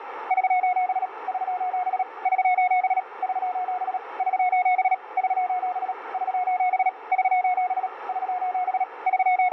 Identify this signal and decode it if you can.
Morse code, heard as a keyed tone, machine-sent, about 37 wpm, 730 Hz, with radio static and a narrow filter. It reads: <SOS> <SOS> <SOS> <SOS> <SOS> <SOS> <SOS> <SOS> <SOS> …